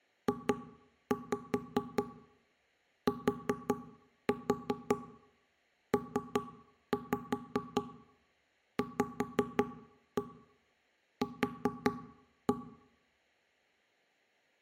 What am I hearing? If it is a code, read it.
Tap code, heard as knocks on wood, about 5 knocks a second, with room echo. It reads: JTPVQ